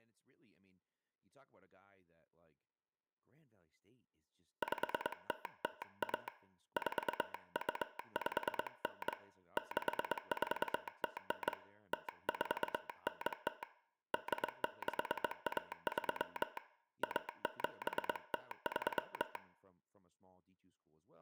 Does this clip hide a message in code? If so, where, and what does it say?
Yes: Morse code (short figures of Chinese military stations) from 4.6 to 19.4 s, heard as a telegraph sounder, hand-sent with a straight key, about 22 wpm, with room echo and speech in English. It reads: 5001 4259 6409 0490 8613 1703